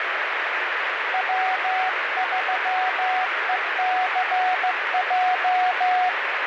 Morse code, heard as a keyed tone, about 15 wpm, 740 Hz, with heavy radio static. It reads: W3ECJ